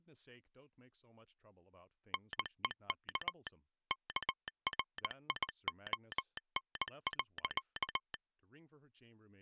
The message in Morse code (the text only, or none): NEK KRION.